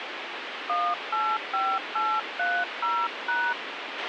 DTMF, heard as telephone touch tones, dialled by hand, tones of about 250 ms, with radio hiss and a squelch burst at the end. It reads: 185830#